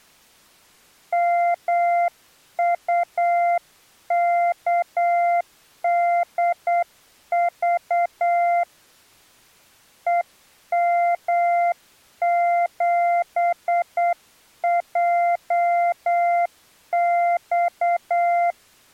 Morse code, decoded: MUKDV EM7JX

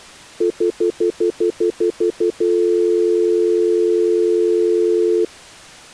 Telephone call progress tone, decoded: stutter dial tone

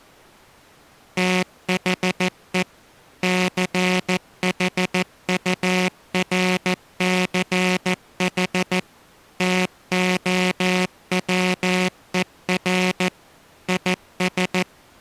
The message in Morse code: THE CHURCH TOWER IS

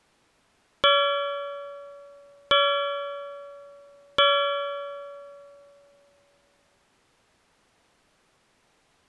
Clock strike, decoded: 3

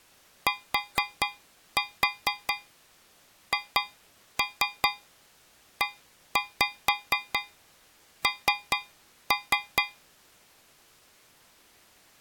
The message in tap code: THEN

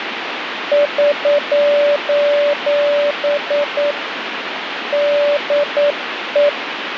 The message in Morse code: <SOS> DE

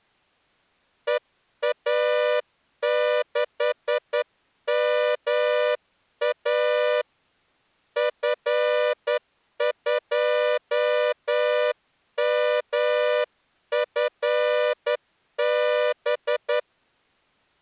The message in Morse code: EA6MA F2MFB

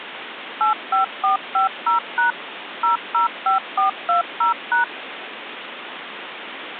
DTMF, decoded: 85450# 005420#

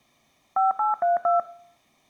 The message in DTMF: 5832

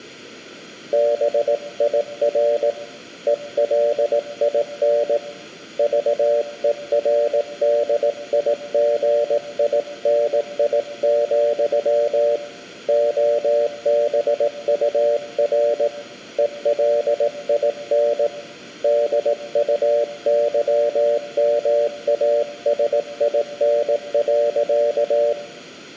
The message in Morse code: BIR ELIN VERDIGINI, OBUR ELIN DUYMASIN.

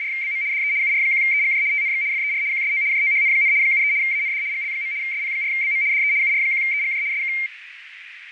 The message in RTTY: … DE UR1EGJ TNX FER QSO JOHN, 73 AND GL. SP4BM DE UR1EGJ SK

